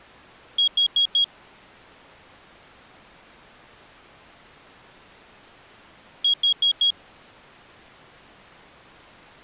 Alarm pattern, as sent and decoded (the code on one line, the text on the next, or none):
4 beeps and a pause
temporal four